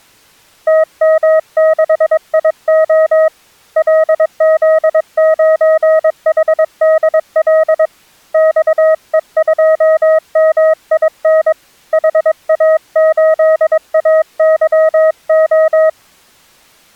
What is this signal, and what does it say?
Morse code, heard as a keyed tone, hand-sent with a paddle, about 22 wpm, 630 Hz. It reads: TM6IO LZ9HDL XE2MIN HA8AYO